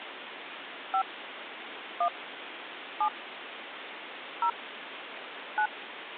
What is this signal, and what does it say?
DTMF, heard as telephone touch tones, dialled by hand, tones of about 80 ms, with phone line noise. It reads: 5 1 7 0 9